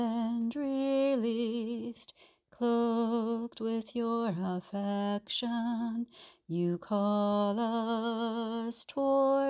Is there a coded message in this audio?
No.